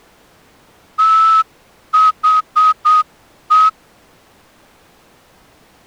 Morse code, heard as a whistle, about 8 wpm. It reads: THE